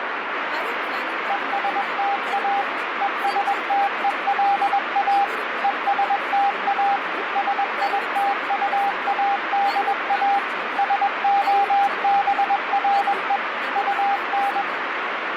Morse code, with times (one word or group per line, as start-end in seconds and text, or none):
1.3-2.6 ESTA
3.0-5.2 ESTELA
5.6-7.0 ESTA
7.4-10.4 SITUADA
10.8-13.4 SOBRE
13.8-14.6 UN